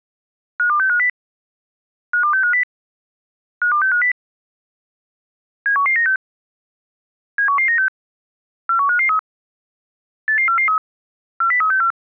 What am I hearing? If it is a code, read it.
Five-tone selective call (CCIR), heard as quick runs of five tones, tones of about 100 ms. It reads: 52650 52650 52650 71196 71196 41553 88443 40364